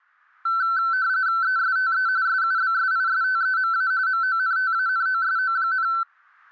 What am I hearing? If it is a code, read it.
RTTY (45.45 baud, 170 Hz shift), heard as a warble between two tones, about 1430 Hz centre, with static crashes. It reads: ESTE SUBSISTEMA MONTANOSO,